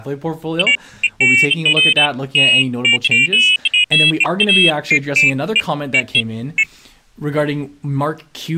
Pairs of high tones at irregular times, with speech in English. There is no code.